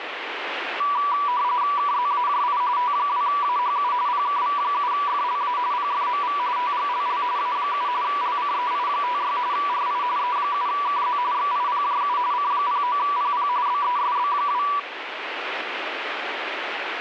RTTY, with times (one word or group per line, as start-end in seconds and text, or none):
1.8-2.6 KZAJI
2.8-3.9 T2AHU
4.1-5.6 PKV7FLA
5.7-6.4 PFMV
6.6-7.2 TGLL
7.4-7.9 A7
8.0-9.4 LCEI56
9.5-10.0 RI
10.2-11.2 E7KZ
11.3-12.2 XIPJU
12.3-13.5 C09PP
13.7-14.6 BESB2